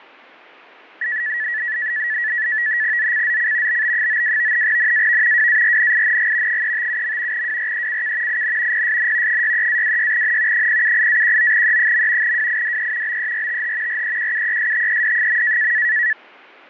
NAVTEX (SITOR-B), 100 baud, 170 Hz shift, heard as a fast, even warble, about 1800 Hz centre. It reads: ZCZC BB92 NAV WARNING 357. WRECK IN PSN 63-26N 078-19E. WIDE BERTH REQUESTED.